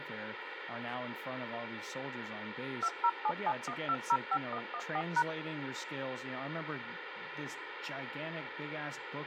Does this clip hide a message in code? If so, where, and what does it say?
Yes: DTMF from 2.8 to 5.2 s, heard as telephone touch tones, dialled by machine, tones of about 60 ms, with radio hiss and speech in English. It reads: 20771205114#